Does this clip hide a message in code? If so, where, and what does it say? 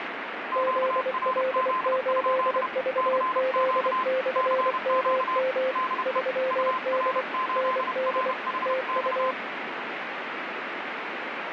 Yes: Morse code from 0.5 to 9.4 s, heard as two keyed tones, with radio static. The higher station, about 31 wpm, 1030 Hz: QRZ? CQ CQ DE UR8RHX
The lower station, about 24 wpm, 520 Hz: ZL8VZ/MM 3D ND TU